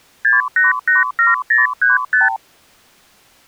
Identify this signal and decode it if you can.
Multi-frequency trunk signalling (R2, with the far end's replies), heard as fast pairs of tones, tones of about 160 ms. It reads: 6887035